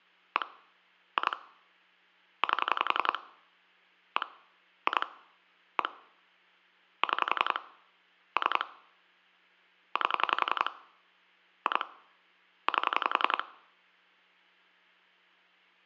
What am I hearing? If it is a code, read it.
Pulse dialling, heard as clicks on a phone line, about 11 pulses a second, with hum. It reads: 1 2 8 1 2 1 6 3 8 2 8